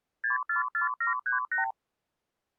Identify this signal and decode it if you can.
Multi-frequency trunk signalling (R2, with the far end's replies), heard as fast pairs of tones, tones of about 130 ms. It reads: 644738